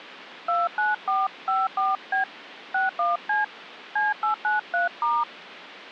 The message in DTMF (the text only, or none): 29454B 61C C893*